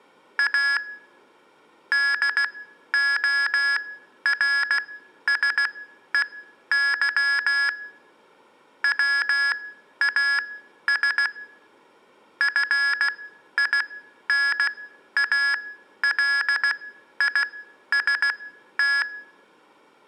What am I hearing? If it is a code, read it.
Morse code, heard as electronic beeps, machine-sent, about 16 wpm, spaced as for 11 wpm, 1700 Hz, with room echo. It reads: A DORSEY WAS FINALIST